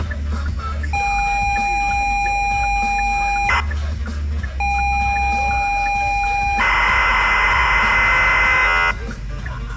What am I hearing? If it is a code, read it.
ZX Spectrum tape loading, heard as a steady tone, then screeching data, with the noise inside a car.